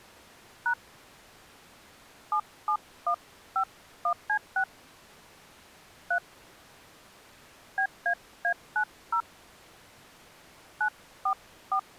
DTMF, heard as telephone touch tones, dialled by hand, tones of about 80 ms. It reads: # 77151C6 3 BAA90 944